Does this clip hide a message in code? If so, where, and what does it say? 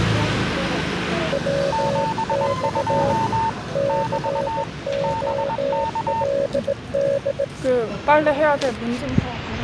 Yes: Morse code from 1.3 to 7.5 s, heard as two keyed tones, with the noise of a residential street. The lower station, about 18 wpm, 560 Hz: WX COLD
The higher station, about 21 wpm, 900 Hz: 72 <BT> BK